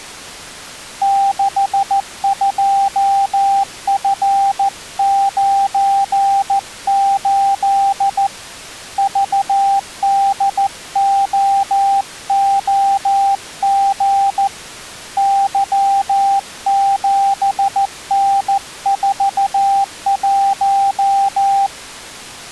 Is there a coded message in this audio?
Yes: Morse code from 1.0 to 21.7 s, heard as a keyed tone, hand-sent with a paddle, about 14 wpm, 790 Hz. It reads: 62F98 VDOOG Y7N41